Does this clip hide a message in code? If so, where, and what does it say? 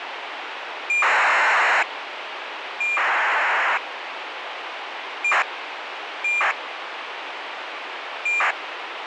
Yes: ACARS aircraft data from 0.9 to 8.5 s, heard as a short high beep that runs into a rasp, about 2400 baud, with radio hiss.